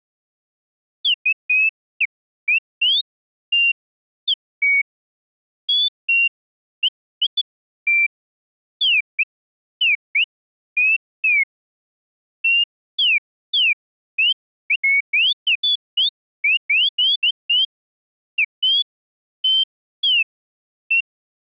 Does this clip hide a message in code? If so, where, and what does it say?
No, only bird-like chirps.